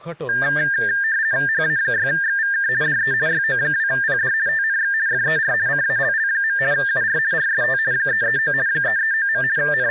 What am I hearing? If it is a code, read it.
RTTY (50 baud, 170 Hz shift), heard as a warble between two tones, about 1700 Hz centre, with speech in Odia. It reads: HA6XVK DE YO2PD TNX FER CALL. UR RST 339 339. …